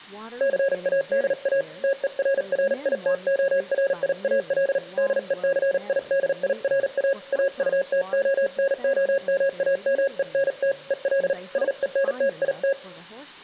Morse code, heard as a keyed tone, hand-sent with a paddle, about 38 wpm, 550 Hz, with room echo and speech in English. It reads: CADA TERRITORIAL DECIDIRA AUTONOMAMENT EL SENTIT